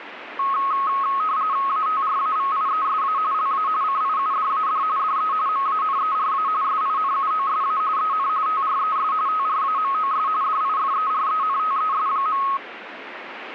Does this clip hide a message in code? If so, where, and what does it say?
Yes: RTTY (45.45 baud, 170 Hz shift) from 0.4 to 12.6 s, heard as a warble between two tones, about 1180 Hz centre, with radio static. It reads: ATRAVIESA LA CIUDAD DE MANERA SINUOSA EN TRES TRAMOS DIFERENTES.